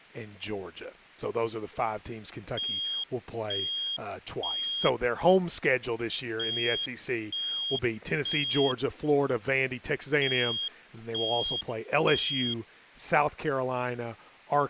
Alarm pattern, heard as an alarm's beeps, played three times, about 3250 Hz, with speech in English. Temporal three. Smoke or fire, evacuate.